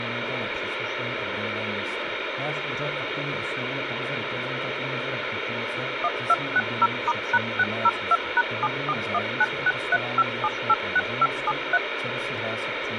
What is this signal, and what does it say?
DTMF, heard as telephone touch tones, dialled by machine, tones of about 40 ms, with phone line noise. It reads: 1260*#602#7419635786573